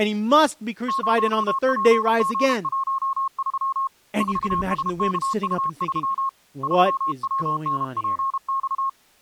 Morse code, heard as a keyed tone, hand-sent with a paddle, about 32 wpm, 1080 Hz, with speech in English. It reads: 0PG13 4SKU3 3WNPX